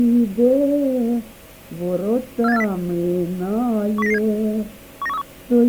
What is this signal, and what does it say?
Five-tone selective call (EEA), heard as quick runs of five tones, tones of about 40 ms. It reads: 47840 10997 19131